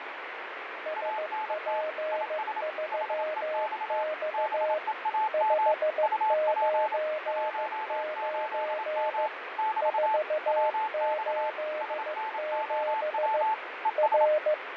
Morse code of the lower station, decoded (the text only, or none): SP3X 599 487 R